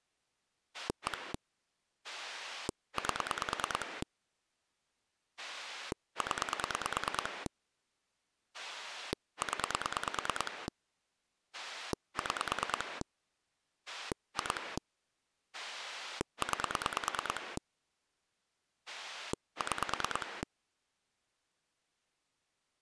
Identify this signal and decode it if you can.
Pulse dialling, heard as a rotary dial, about 9 pulses a second. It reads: 1 8 0 0 6 2 9 6